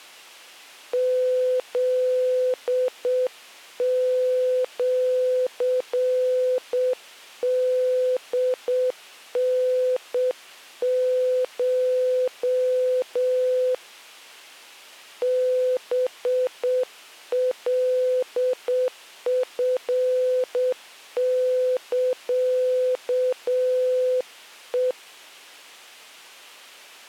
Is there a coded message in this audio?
Yes: Morse code (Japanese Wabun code) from 0.9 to 25.0 s, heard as a keyed tone, hand-sent with a straight key, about 7 wpm, 510 Hz. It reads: フシホタコ ハカチサヘ